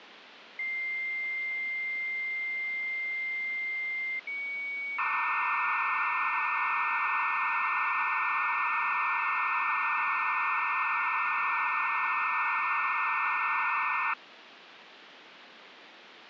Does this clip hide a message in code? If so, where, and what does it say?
Yes: dial-up modem handshake (low-speed, two carriers) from 0.6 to 14.1 s, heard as two whistles, then hiss, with phone line noise.